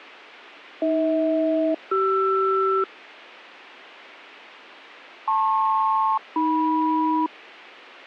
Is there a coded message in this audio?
Yes: aircraft SELCAL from 0.8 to 7.3 s, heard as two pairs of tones. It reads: AH-CR LP-AM